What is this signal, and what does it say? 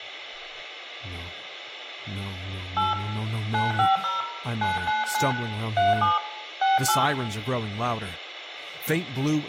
DTMF, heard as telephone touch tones, dialled by hand, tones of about 170 ms, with room echo. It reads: 8 950 999 37 68